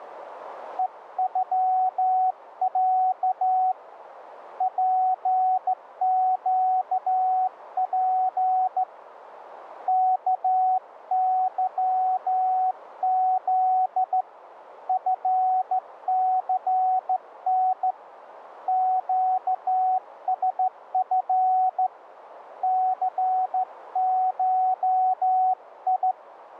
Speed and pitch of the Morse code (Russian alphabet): 14 wpm, 750 Hz

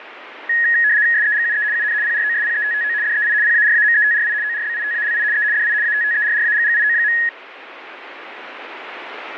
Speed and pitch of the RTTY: 75 baud, 170 Hz shift, 1800 Hz centre

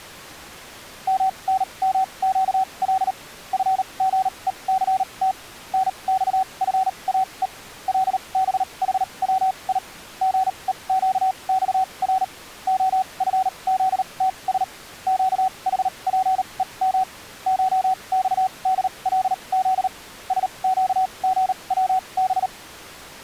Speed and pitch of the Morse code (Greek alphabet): 38 wpm, spaced as for 28 wpm, 760 Hz

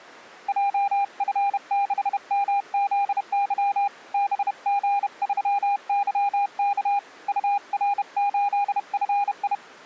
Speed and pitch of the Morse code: 31 wpm, 810 Hz

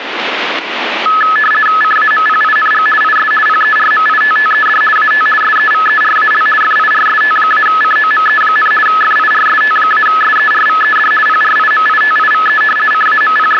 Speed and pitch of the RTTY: 50 baud, 450 Hz shift, 1500 Hz centre

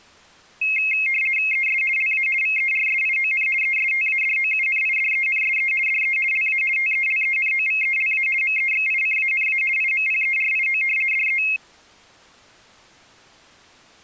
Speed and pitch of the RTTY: 50 baud, 450 Hz shift, 2350 Hz centre

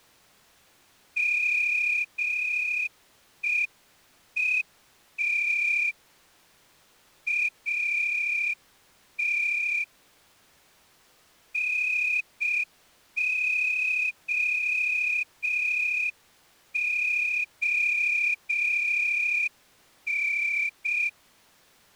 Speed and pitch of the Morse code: 6 wpm

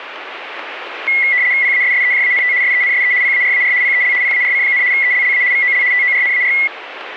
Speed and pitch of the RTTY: 75 baud, 170 Hz shift, 2050 Hz centre

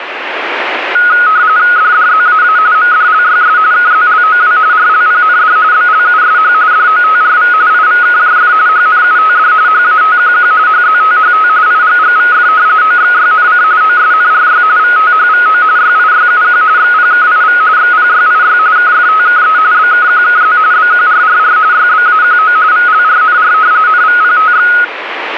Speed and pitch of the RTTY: 45.45 baud, 170 Hz shift, 1360 Hz centre

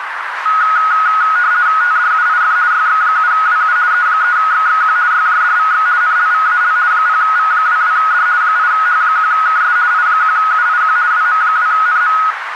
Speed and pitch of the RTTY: 50 baud, 170 Hz shift, 1360 Hz centre

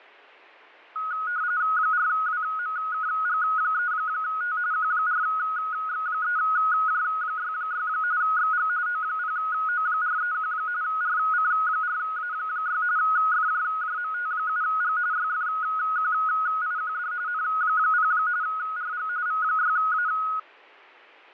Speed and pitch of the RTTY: 45.45 baud, 170 Hz shift, 1360 Hz centre

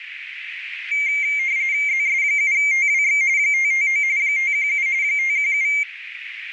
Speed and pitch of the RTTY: 45.45 baud, 170 Hz shift, 2200 Hz centre

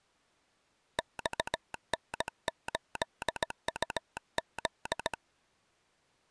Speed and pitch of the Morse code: 17 wpm

